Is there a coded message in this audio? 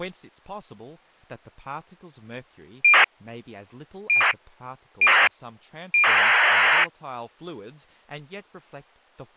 Yes: ACARS aircraft data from 2.8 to 6.8 s, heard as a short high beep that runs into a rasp, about 2400 baud, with speech in English.